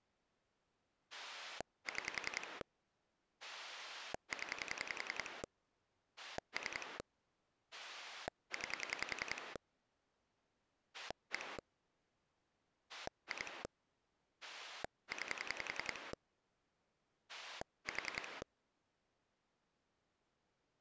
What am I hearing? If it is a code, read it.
Pulse dialling, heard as a rotary dial, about 10 pulses a second. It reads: 6 0 3 9 1 2 9 4